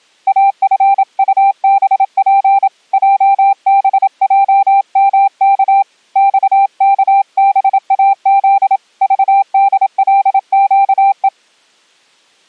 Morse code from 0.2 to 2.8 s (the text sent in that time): AFUBP